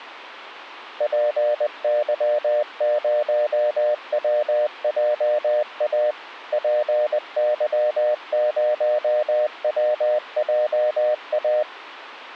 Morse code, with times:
1.0-6.1 PY0WJA
6.5-11.6 PY0WJA

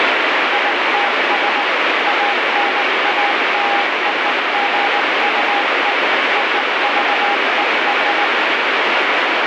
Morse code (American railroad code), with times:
0.5-1.6 ITS
2.1-5.9 ANALOGUE
6.4-8.2 OVER

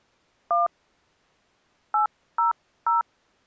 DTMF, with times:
0.5-0.7 1
1.9-3.0 800

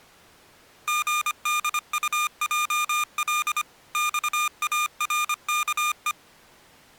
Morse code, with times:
0.9-3.6 GDUJL
3.9-6.1 XARKE

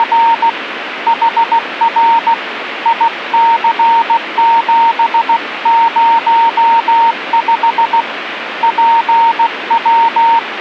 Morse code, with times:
0.0-0.5 …
1.1-2.3 HR
2.9-8.0 IC705
8.6-10.6 …

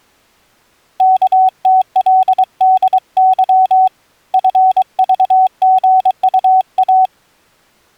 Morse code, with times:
1.0-3.9 KTLDY
4.3-7.1 FVGUA

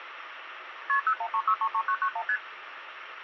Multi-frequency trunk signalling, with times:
0.9-1.0 KP
1.1-2.2 013633991
2.3-2.4 ST

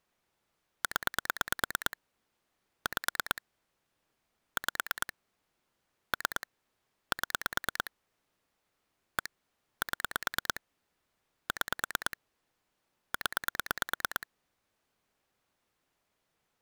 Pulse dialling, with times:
0.8-2.0 0
2.9-3.4 5
4.6-5.1 5
6.1-6.5 3
7.1-7.9 7
9.2-9.3 1
9.8-10.6 7
11.5-12.2 6
13.1-14.3 0

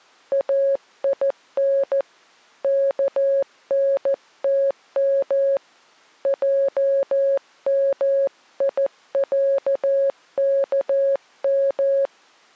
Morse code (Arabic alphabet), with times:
0.3-2.0 اين
2.6-5.6 كنتم
6.3-12.1 جميعكم

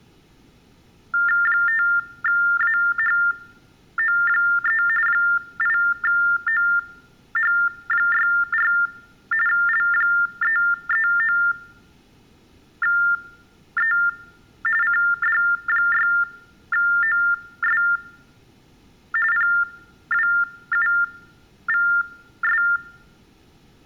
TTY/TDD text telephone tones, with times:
1.5-4.8 5AHO3
5.1-8.7 8OH64
9.5-13.9 L339E
14.8-17.8 CD6OS
19.3-22.6 PWUVS

